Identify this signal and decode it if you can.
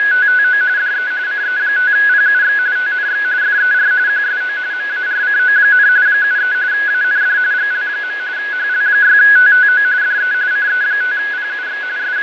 RTTY (45.45 baud, 170 Hz shift), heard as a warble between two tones, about 1600 Hz centre, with radio static, fading and a steady whistle near 2110 Hz. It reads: … DE CE5PUX TNX FER QSO MARCO, 73 AND GL. HL6TTO DE CE5PUX …